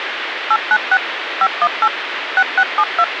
DTMF, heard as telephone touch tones, dialled by machine, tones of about 60 ms, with phone line noise. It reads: 896 518 6672